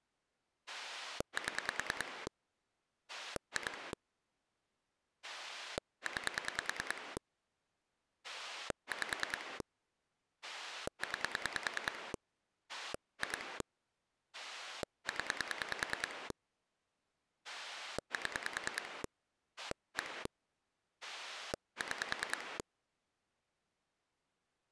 Pulse dialling, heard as a rotary dial, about 10 pulses a second. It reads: 7 2 9 5 9 2 0 7 1 6